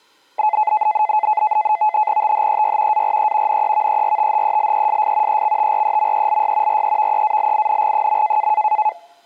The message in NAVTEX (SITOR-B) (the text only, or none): THEY ARE NEVERTHELESS EXTREMELY REVEALING.